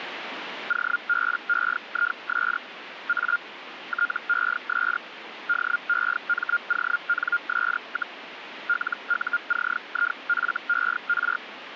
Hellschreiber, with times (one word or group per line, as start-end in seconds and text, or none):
0.7-2.6 OBEIS
3.1-3.4 A
3.9-5.0 TES
5.5-8.2 DEMONS,
8.7-11.4 LUCIFER